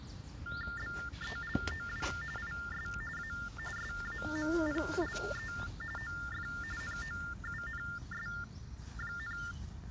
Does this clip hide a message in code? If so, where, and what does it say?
Yes: TTY/TDD text telephone tones (45.45 baud Baudot) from 0.5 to 9.5 s, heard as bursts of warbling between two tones, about 400 Hz shift, 1600 Hz centre, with the noise of a park. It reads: BELOW IS A SAMPLE OF NOUNS,